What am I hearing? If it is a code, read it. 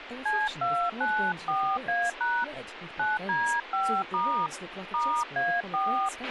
DTMF, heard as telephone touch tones, dialled by hand, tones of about 260 ms, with radio hiss, a squelch burst at the end and speech in English. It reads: C294A# 9D5* *A4